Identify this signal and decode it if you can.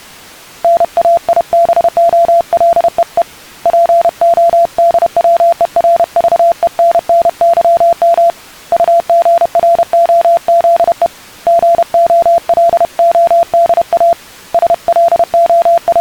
Morse code (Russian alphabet), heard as a keyed tone, hand-sent with a paddle, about 31 wpm, 680 Hz. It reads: НАИБОЛЕЕ ПОДВЕРЖЕННЫМ УГРОЗЕ ГОЛОДА …